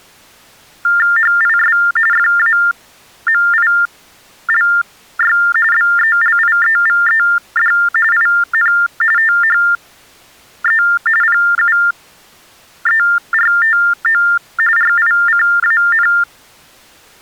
TTY/TDD text telephone tones (45.45 baud Baudot), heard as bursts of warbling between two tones, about 400 Hz shift, 1600 Hz centre. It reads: HIS FAMILY BELIEVED IN THE PUERTO RICAN